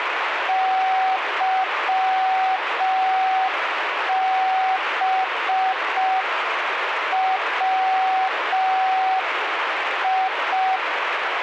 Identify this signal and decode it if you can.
Morse code, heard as a keyed tone, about 5 wpm, 760 Hz, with radio static. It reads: YBWI